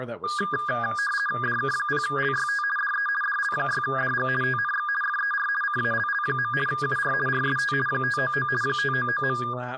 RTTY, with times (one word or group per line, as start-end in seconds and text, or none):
1.4-2.6 DK0LYT
2.8-3.1 DE
3.2-4.3 DL6DG
4.4-4.9 TNX
5.0-5.5 FER
5.6-6.5 CALL.
6.7-7.1 UR
7.3-7.7 RST
7.9-8.5 599
8.6-9.4 599.